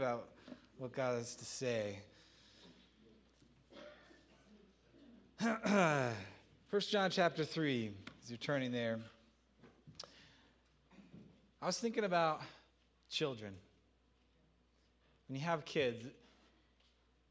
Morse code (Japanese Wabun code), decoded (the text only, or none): none